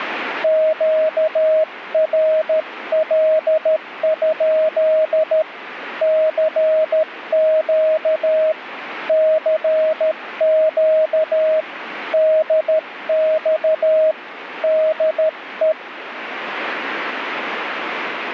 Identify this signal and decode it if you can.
Morse code, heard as a keyed tone, hand-sent with a paddle, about 13 wpm, 630 Hz, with radio static. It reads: QRL? CQ CQ DX DE